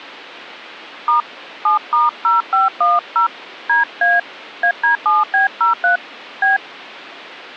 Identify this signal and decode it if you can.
DTMF, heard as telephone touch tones, dialled by hand, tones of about 130 ms. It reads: * 7*0510 DA AD7B03 B